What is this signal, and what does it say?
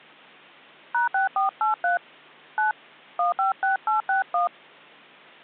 DTMF, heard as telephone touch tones, dialled by hand, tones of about 130 ms. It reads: #6483 9 156861